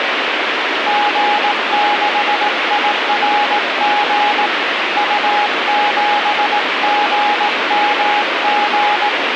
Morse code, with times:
0.9-4.5 G6IRG
5.0-9.1 U7GMG

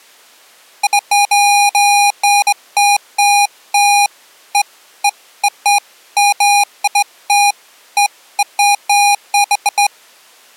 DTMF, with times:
none

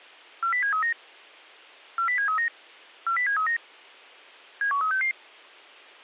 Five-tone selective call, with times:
0.4-0.9 40739
2.0-2.5 40739
3.1-3.6 40739
4.6-5.1 71366

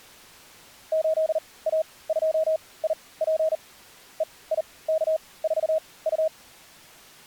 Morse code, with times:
0.9-3.5 8A2IP
4.2-6.3 EIK4U

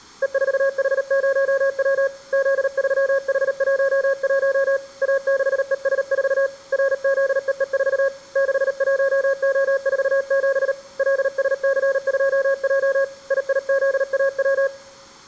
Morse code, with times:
0.2-2.1 E4H0W
2.3-4.8 Z3H11
5.0-6.5 A6ES4
6.7-8.1 RZEE4
8.4-10.7 61O47
11.0-13.0 LSC2J
13.3-14.7 IIZAW

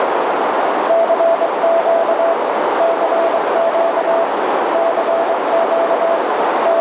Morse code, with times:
0.9-2.3 CQ
2.8-4.2 CQ
4.7-6.2 CQ
6.7-6.8 …

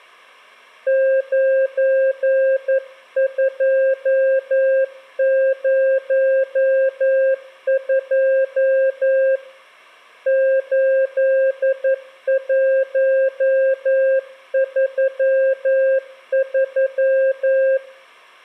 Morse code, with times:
0.9-9.4 9202
10.3-17.8 8133

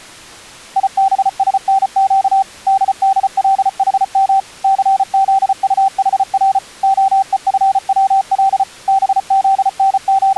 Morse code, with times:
0.8-2.4 IBSNQ
2.7-4.4 DDLHM
4.6-6.6 CZUHR
6.8-8.6 OEFWL
8.9-10.4 …

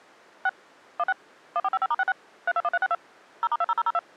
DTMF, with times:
0.5-0.5 6
1.0-1.1 16
1.6-2.1 1455*66
2.5-2.9 321362
3.4-4.0 0*20002

